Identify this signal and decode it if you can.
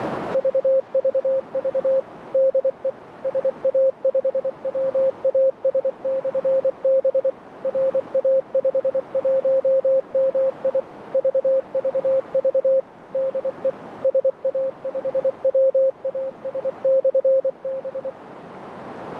Morse code, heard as a keyed tone, machine-sent, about 24 wpm, 530 Hz, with radio static and a narrow filter. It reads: VVV DE SA5WAS/B RA51MI VVV DE SA5WAS/B